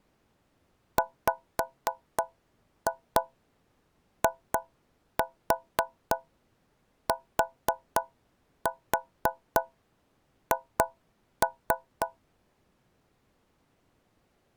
Tap code, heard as taps on a metal pipe, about 3 knocks a second. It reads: WITH